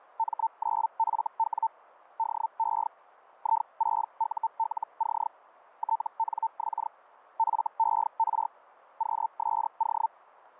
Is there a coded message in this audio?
Yes: Hellschreiber (Feld-Hell, 122.5 baud) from 0.2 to 10.1 s, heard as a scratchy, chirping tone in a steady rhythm, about 900 Hz. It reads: M9FW DE I6ULC TNX FER QSO